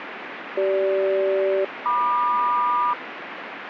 Aircraft SELCAL, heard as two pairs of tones, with radio static. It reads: CG-MQ